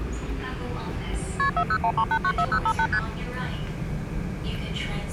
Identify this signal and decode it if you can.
Multi-frequency trunk signalling (R1, as on North American trunks), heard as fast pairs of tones, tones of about 70 ms, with the noise inside a subway train. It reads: KP 4013894058 ST